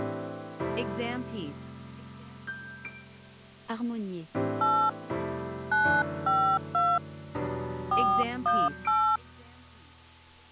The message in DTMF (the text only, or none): 8 952 418